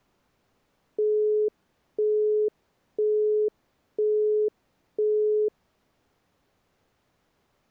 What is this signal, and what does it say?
Telephone call progress tone (single-tone plan, as in Europe, Japan and elsewhere), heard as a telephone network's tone, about 420 Hz, 0.5 s on and 0.5 s off. Busy tone.